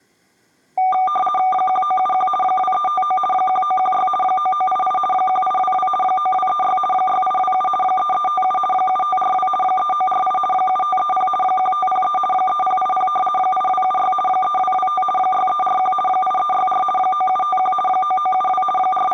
RTTY (50 baud, 450 Hz shift), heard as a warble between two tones, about 980 Hz centre. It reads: 1971 2359 1916 9988 1822 9236 6827 3357 7542 3948 7530 1503 3080 8276 3225 6341 8364 9751 9972 …